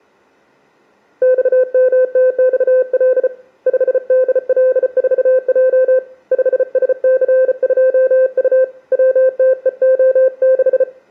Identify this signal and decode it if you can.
Morse code, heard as a keyed tone, hand-sent with a bug key, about 34 wpm, 520 Hz, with room echo. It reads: XMTXL 5DL4J 5SC2U WTEO6